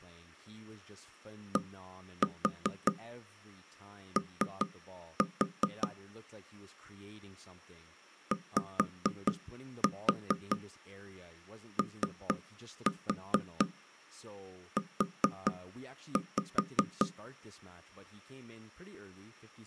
Tap code, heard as knocks on wood, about 4 knocks a second, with speech in English. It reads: DO YOU